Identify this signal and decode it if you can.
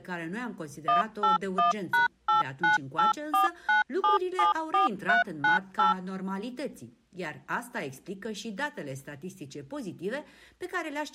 DTMF, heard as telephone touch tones, dialled by machine, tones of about 140 ms. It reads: 181#89849774398